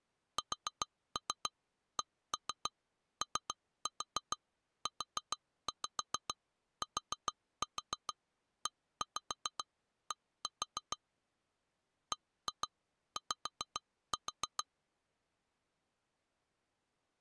Tap code, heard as taps on glass, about 7 knocks a second. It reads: SCOUTED BY